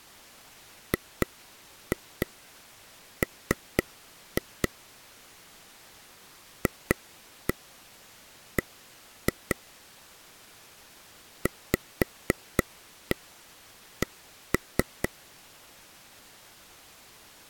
Tap code, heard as taps on a table, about 4 knocks a second. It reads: GM FB VC